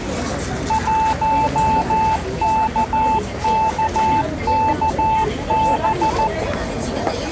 Morse code, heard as a keyed tone, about 14 wpm, 880 Hz, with the noise of a crowd indoors. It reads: 1KKKB